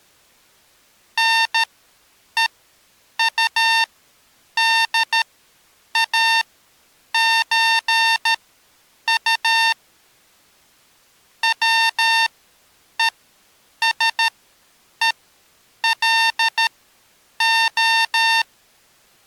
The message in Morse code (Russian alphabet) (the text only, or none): НЕУДАЧУ ВЕСЕЛО